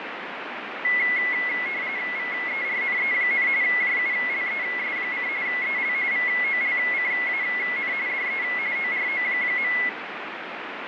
RTTY (45.45 baud, 170 Hz shift), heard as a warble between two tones, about 2050 Hz centre, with radio static and fading. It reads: VERNE, JULES: EL VOLCAN DE ORO.